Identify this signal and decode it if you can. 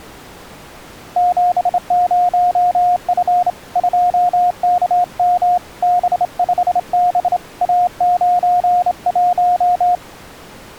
Morse code, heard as a keyed tone, hand-sent with a straight key, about 28 wpm, 710 Hz. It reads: 70F 2KM B5B A91